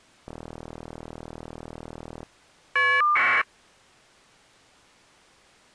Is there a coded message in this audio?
Yes: caller ID data burst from 0.3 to 3.4 s, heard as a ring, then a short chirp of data, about 1200 baud.